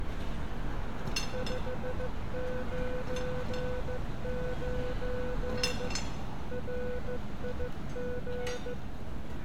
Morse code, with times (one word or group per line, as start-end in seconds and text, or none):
1.3-5.9 599
6.5-8.7 RIG